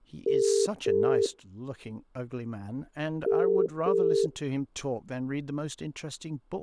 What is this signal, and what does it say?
Telephone call progress tone (as in the UK, Ireland, Australia and similar networks), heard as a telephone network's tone, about 400, 450 Hz, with speech in English. Ringback tone.